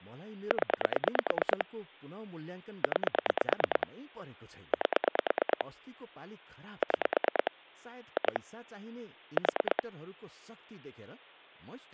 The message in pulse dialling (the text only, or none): 0 9 8 6 2 4